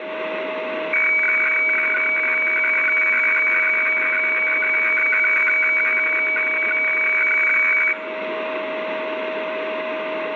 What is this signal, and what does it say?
Weather fax (radiofax), 120 lines a minute, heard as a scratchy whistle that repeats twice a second, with radio static and a steady whistle near 630 Hz.